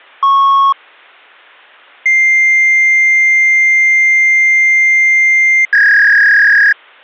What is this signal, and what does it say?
Fax machine handshake, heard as a beep, a long tone and a warble.